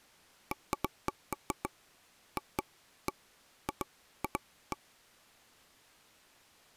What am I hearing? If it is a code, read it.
Irregular taps on a table. There is no code.